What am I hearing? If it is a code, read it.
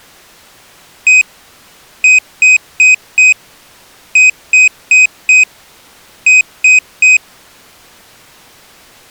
Beep code, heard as a piezo beeper, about 2500 Hz. 1-4-4-3.